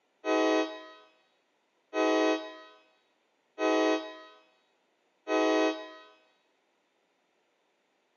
Train horn signal, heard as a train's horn, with room echo. 4 short. On North American railways: a request for a signal to be given or repeated.